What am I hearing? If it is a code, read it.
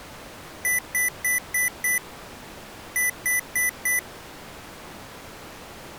Beep code, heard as beeps from a small speaker, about 2000 Hz. 5-4.